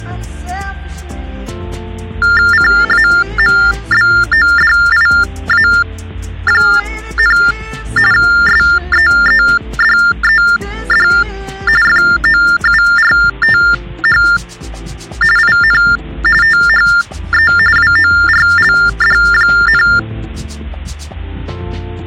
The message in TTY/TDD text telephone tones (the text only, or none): CAMBODIA, SEEDED FOURTH IN THE WORLD,